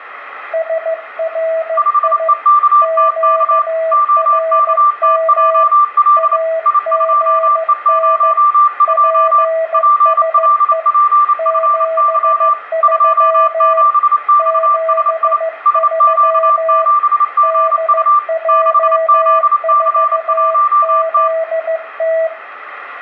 Morse code, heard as two keyed tones, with radio static and room echo. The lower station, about 15 wpm, 650 Hz: SRI QRM AGN PSE 73 73 DJ4ZT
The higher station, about 28 wpm, 1180 Hz: 5EKTK OKTJL I2E02 PLPFY 27XSI SQ7GU 6ZC1T